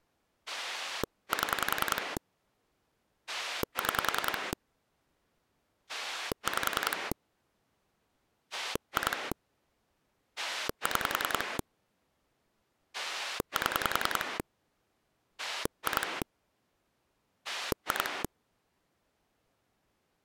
Pulse dialling, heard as a rotary dial, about 10 pulses a second. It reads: 7 6 5 2 6 7 2 2